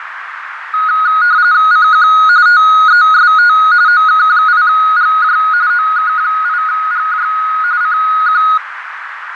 RTTY (45.45 baud, 170 Hz shift), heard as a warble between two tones, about 1350 Hz centre, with radio static, fading and a narrow filter. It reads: CQ TEST OK8GJ OK8GJ CQ